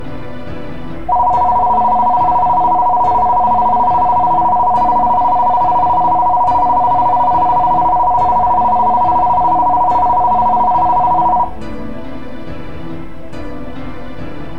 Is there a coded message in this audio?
No, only a tone that alternates evenly between two pitches.